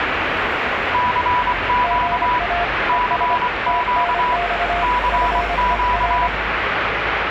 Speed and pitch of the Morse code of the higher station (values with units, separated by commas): 24 wpm, 980 Hz